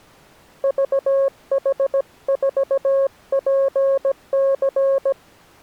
Morse code, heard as a keyed tone, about 17 wpm, 540 Hz. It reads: VH4PC